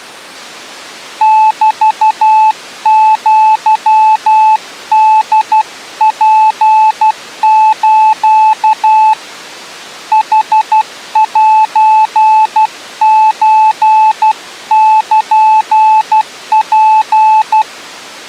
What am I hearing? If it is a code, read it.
Morse code (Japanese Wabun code), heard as a keyed tone, hand-sent with a paddle, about 12 wpm, 870 Hz. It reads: メアホツス ヌセソルツ